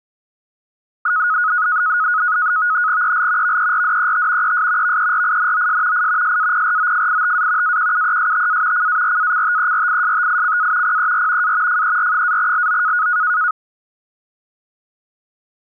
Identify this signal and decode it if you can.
NAVTEX (SITOR-B), 100 baud, 170 Hz shift, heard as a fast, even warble, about 1360 Hz centre. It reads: EL VERDET ES VERINOS I SAPROFITA AQUESTA CARACTERISTICA PER A FER-LO